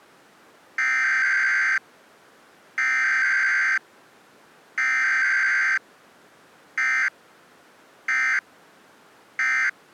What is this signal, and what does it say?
Emergency Alert System (SAME) tones (header bursts, then end-of-message bursts), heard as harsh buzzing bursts, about 520.83 baud.